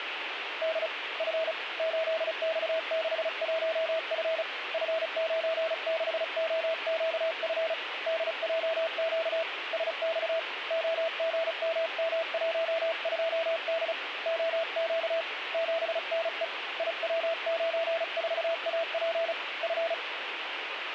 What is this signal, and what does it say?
Morse code, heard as a keyed tone, hand-sent with a paddle, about 35 wpm, 660 Hz, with radio static. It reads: D F 8X61F F96OQF DJQ SX OGMM12D OQ 7NE IW94AP F